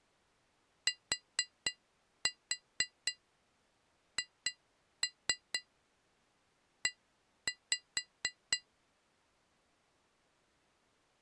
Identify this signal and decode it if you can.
Tap code, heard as taps on glass, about 4 knocks a second. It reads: THE